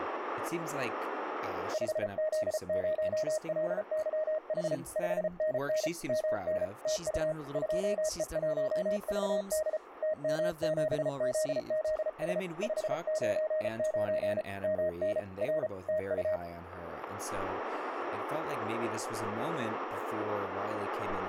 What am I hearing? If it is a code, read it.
Morse code, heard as a keyed tone, hand-sent with a paddle, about 34 wpm, 620 Hz, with radio static and speech in English. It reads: 5Z0LYH 5NN MN TU 2E1VD TM7ZZS 599 MN R TU